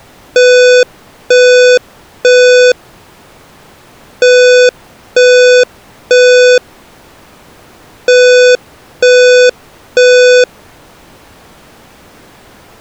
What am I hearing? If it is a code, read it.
Alarm pattern, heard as an alarm's beeps, played three times, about 500 Hz. Temporal three. Smoke or fire, evacuate.